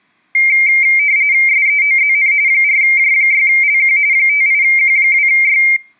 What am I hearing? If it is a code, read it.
RTTY (45.45 baud, 170 Hz shift), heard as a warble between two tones, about 2200 Hz centre. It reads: SEOZN 4J6LQ 58Q2Y